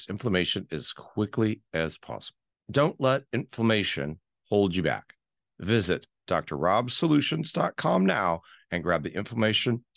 Speech in English. There is no code.